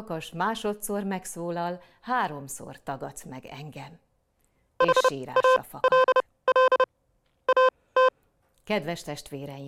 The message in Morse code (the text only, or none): HALL AT